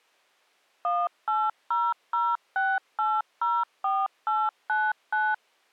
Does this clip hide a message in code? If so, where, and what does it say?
Yes: DTMF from 0.8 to 5.3 s, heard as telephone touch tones, dialled by machine, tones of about 220 ms. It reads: 18006804899